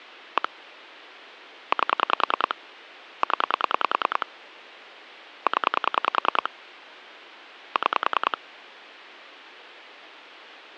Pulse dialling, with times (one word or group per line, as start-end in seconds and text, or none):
0.4-0.5 1
1.7-2.5 8
3.2-4.3 0
5.5-6.5 0
7.8-8.4 6